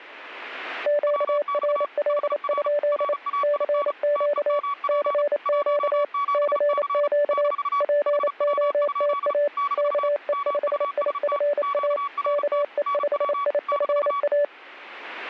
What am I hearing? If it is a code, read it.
Morse code, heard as two keyed tones. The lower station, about 28 wpm, 580 Hz: QRL? CQ CQ CQ POTA KE5IFA KE5IFA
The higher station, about 35 wpm, 1130 Hz: WX HR RAIN TEMP 17C - HW? - MUST QRT NW -